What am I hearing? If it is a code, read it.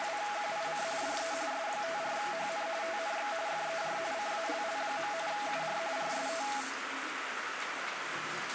RTTY (45.45 baud, 170 Hz shift), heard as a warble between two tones, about 740 Hz centre, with radio static and the noise of a restroom. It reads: … DE S54HN TNX FER CALL. UR RST